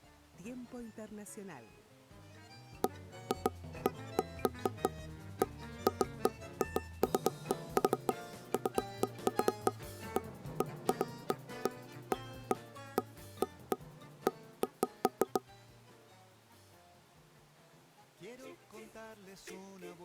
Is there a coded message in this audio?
No, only irregular knocks on wood.